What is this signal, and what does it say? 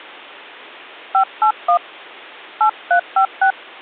DTMF, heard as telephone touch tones, dialled by hand, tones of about 90 ms. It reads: 581 8356